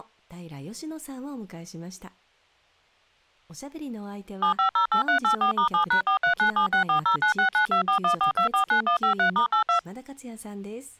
DTMF, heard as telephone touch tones, dialled by machine, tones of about 100 ms, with speech in Japanese. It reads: 7508384*7#43976409692414249153*82